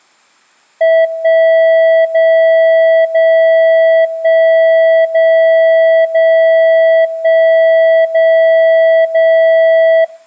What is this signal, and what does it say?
Radio time signal (DCF77), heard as a tone whose level steps once a second, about 650 Hz, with room echo. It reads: 1 0 0 1 0 0 1 0 0